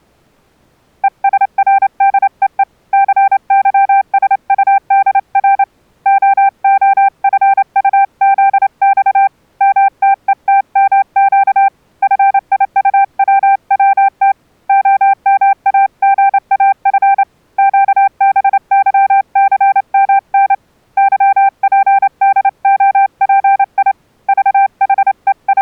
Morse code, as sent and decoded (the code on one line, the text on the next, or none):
. ... .-. -.. . . / -.-. -.-- ... ..- -.. .-. / --- --- ..-. ..- --.. -..- / -- - . - -- --.- / ..-. .. ..- .-- .-- - / --- -- .- --. .- ..-. / --.- -... -.-- -.-. -- -. / -.-- .--. -.. --- .--. .. / …
ESRDEE CYSUDR OOFUZX MTETMQ FIUWWT OMAGAF QBYCMN YPDOPI …